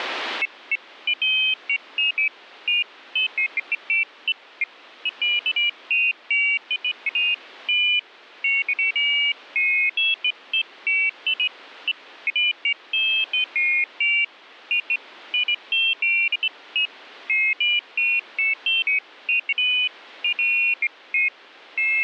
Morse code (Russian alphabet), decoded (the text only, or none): none